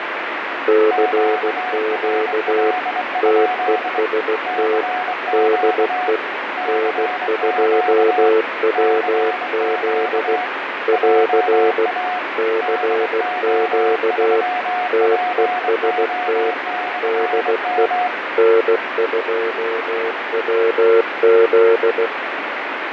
Morse code, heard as two keyed tones, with radio static and fading. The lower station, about 16 wpm, 440 Hz: CQ TEST DE N2WZ <AR> CQ TEST DE N2WZ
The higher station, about 23 wpm, 730 Hz: QRL? CQ CQ CQ JA DO3PO/M